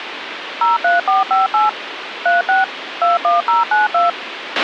DTMF, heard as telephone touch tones, dialled by machine, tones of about 160 ms, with radio hiss and a squelch burst at the end. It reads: 03458 36 21092